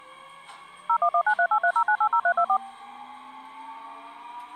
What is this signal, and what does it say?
DTMF, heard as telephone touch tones, dialled by machine, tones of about 70 ms, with the noise inside a subway train. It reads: 01193830980324